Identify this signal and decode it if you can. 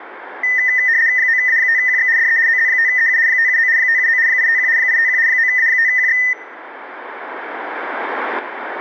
RTTY (75 baud, 170 Hz shift), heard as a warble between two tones, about 1900 Hz centre. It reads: 9A5QX DE OZ5EU 579 579 851 851 9A5QX